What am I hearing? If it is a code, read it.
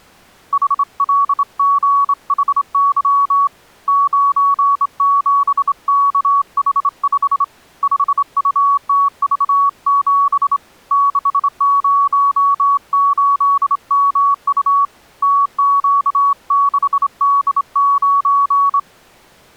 Morse code, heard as a keyed tone, hand-sent with a straight key, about 26 wpm, 1120 Hz. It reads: HLGHY 97KH5 5UTV7 608MU TQ6D9